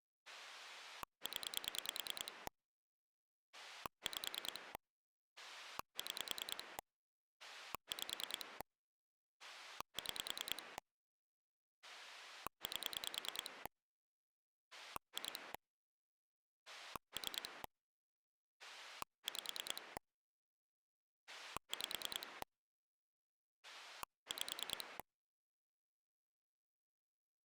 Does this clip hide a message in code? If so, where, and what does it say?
Yes: pulse dialling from 0.3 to 25.0 s, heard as a rotary dial, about 9 pulses a second. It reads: 0 5 6 5 6 8 2 3 5 5 5